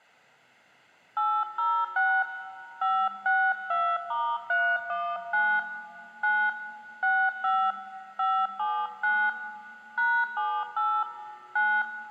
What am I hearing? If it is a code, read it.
DTMF, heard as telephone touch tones, dialled by hand, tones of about 260 ms, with room echo. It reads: 806 562*319 9 65 579 #78 9